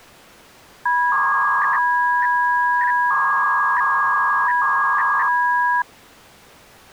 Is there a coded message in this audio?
Yes: 300-baud modem data (V.21 tones) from 0.9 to 5.8 s, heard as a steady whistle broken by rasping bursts, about 300 baud, 200 Hz shift.